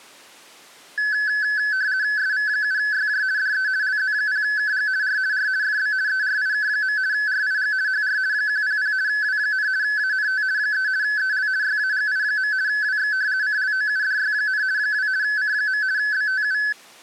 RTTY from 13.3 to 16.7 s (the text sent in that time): CLOUDY, 2 C. BTU